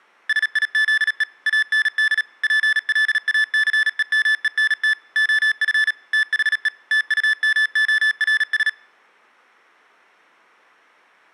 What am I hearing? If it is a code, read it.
Morse code, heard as electronic beeps, machine-sent, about 37 wpm, 1750 Hz. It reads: SIZE AND PLACEMENT OF THE TUMORS